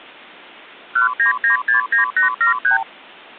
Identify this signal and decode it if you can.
Multi-frequency trunk signalling (R2, with the far end's replies), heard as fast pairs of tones, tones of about 120 ms. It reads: 19969873